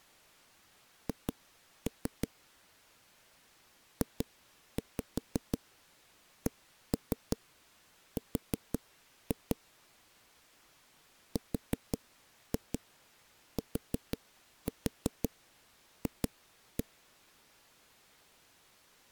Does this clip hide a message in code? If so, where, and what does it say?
Yes: tap code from 1.1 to 16.8 s, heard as knocks on a wall, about 5 knocks a second. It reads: H JCR RTF